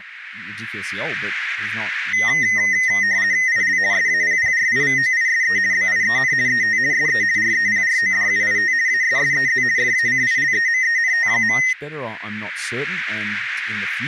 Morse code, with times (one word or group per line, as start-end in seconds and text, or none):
none